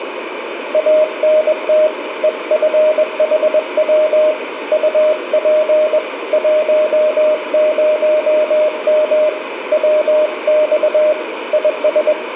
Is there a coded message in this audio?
Yes: Morse code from 0.7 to 12.2 s, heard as a keyed tone, hand-sent with a paddle, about 21 wpm, 610 Hz, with radio static, a weaker station near 2040 Hz and room echo. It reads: ANT EFHW UP 10M WX IS